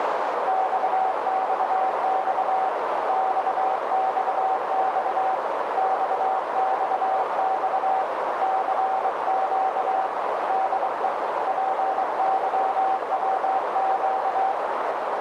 Morse code, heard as a keyed tone, hand-sent with a bug key, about 23 wpm, 760 Hz, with heavy radio static and a narrow filter. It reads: XXX XXX XXX CQ DE PYWQ